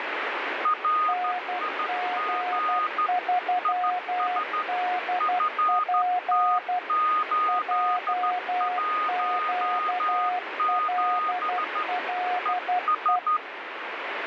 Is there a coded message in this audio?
Yes: Morse code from 0.6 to 13.4 s, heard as two keyed tones, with heavy radio static. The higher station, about 13 wpm, 1240 Hz: RIG IS FT817 ES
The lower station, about 12 wpm, 720 Hz: NG3DP JQLLE